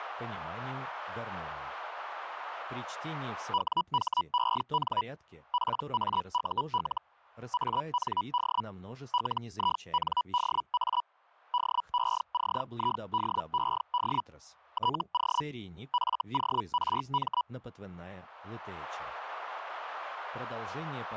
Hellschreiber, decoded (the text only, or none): WHEN PAUL AND LINDA DECIDED TO FORM